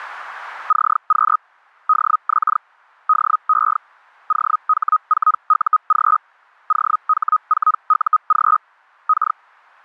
Hellschreiber (Feld-Hell, 122.5 baud), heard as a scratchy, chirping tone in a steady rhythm, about 1260 Hz. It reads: CQ DX DE OH4UG OH4UG K